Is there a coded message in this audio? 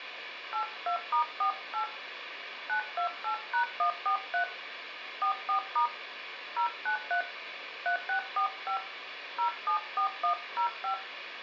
Yes: DTMF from 0.5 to 10.9 s, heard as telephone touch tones, dialled by hand, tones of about 100 ms, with phone line noise. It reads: 82*48 928#143 44* 093 3645 074105